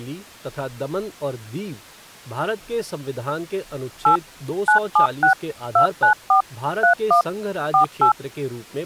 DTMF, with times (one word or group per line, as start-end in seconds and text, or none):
4.1-4.2 8
4.7-5.3 976
5.8-6.4 294
6.8-7.2 31
7.7-8.1 48